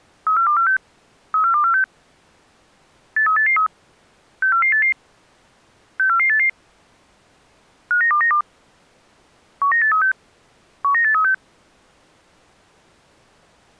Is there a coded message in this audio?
Yes: five-tone selective call (CCIR) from 0.3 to 11.3 s, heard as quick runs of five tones, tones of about 100 ms. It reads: 34246 34246 83883 64488 64488 59292 19836 19836